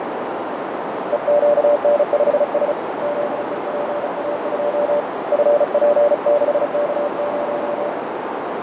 Morse code, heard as a keyed tone, hand-sent with a paddle, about 35 wpm, 580 Hz, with heavy radio static, fading and a narrow filter. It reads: EQN5S ZEPA2 FP6K0